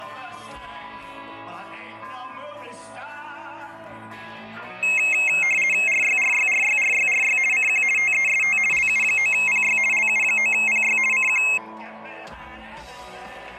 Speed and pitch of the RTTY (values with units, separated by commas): 50 baud, 450 Hz shift, 2350 Hz centre